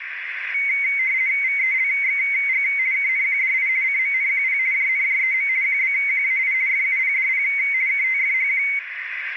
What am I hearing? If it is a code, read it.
RTTY (50 baud, 170 Hz shift), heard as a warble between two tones, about 2150 Hz centre, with radio static and a narrow filter. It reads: VELXG KNQDI CMNQP JNJEM QBQAI FUPDP KTFHQ